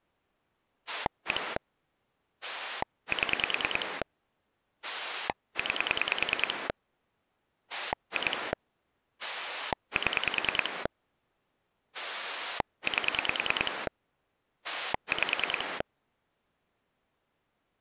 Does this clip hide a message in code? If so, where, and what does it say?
Yes: pulse dialling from 0.9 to 15.8 s, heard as a rotary dial, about 10 pulses a second. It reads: 1 7 9 2 7 8 5